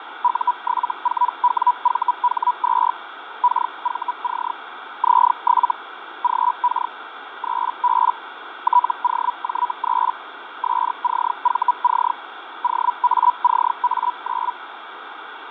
Hellschreiber (Feld-Hell, 122.5 baud), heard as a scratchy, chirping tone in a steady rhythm, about 980 Hz, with radio static and fading. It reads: U74WVH2 KVC Z7 GK 3B TOJ3 SCVC OACA9